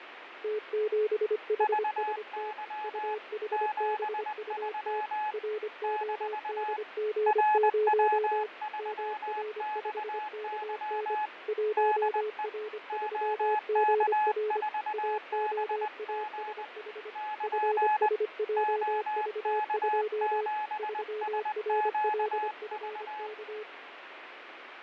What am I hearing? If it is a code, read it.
Morse code, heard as two keyed tones, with radio static and fading. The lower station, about 25 wpm, 430 Hz: T7HST UHBUT RODG0 MR5KN 1R3GR AOASH FSJV2 3RLFK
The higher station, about 20 wpm, 850 Hz: VY 73 - RW3XY DE OK4BG <KN> OK7SQV